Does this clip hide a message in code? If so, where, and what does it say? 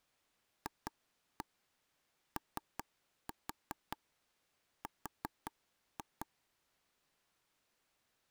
Yes: tap code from 0.7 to 6.2 s, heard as taps on a table, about 5 knocks a second. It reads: FOR